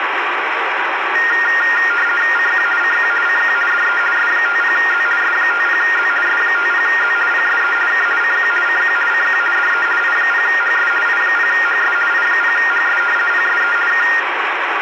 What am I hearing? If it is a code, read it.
RTTY (50 baud, 450 Hz shift), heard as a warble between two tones, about 1650 Hz centre, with radio static. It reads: CQ CQ CQ DE S50Z S50Z S50Z PSE K CQ CQ CQ DE I0HS I0HS I0HS PSE K